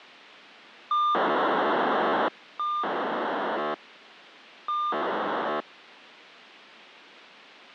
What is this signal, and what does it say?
POCSAG pager data (2400 baud), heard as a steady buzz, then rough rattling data, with radio hiss.